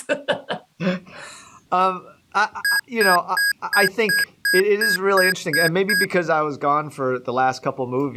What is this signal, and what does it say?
Beep code, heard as beeps from a small speaker, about 1650 Hz, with speech in English. 10 short. In AMI BIOS tables: CMOS shutdown register error.